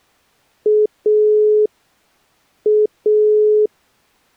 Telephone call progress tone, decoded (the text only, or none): dial tone